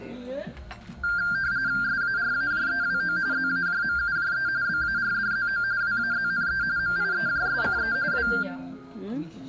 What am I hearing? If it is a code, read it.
RTTY (45.45 baud, 170 Hz shift), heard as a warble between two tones, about 1490 Hz centre, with the noise of a crowd indoors. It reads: SARAJEWO ZAJMUJE BARDZO WAZNE MIEJSCE W